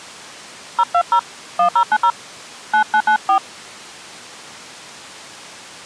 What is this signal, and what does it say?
DTMF, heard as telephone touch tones, dialled by hand, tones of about 80 ms. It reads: 020 1090 9994